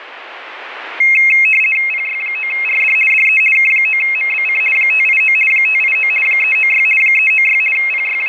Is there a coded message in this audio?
Yes: RTTY (50 baud, 450 Hz shift) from 1.0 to 8.3 s, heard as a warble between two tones, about 2350 Hz centre, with radio static. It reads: PY9RD DE K9MBC 589 589 396 396 …